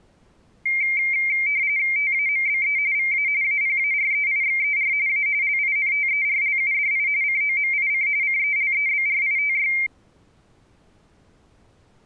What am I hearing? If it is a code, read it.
RTTY (45.45 baud, 170 Hz shift), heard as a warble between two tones, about 2200 Hz centre. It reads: TAMBE VA APAREIXER A LINTERLUDI COMIC CELEBRITY